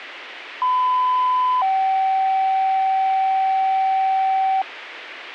Two-tone page, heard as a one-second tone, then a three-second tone, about 1010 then 770 Hz, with radio hiss.